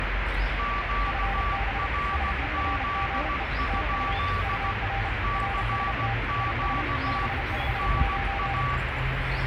Morse code, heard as two keyed tones, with heavy radio static and the noise of a park. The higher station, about 16 wpm, 1150 Hz: QRZ? CQ NA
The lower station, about 32 wpm, 790 Hz: FB SERGE TU UR RST IS 559